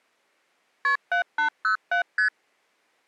Multi-frequency trunk signalling (R1, as on North American trunks), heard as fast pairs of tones, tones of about 110 ms. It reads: KP 7807 ST